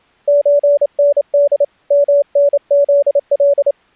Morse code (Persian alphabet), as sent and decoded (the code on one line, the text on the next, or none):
---. -. -.. / -- -. --.. .-..
چند منزل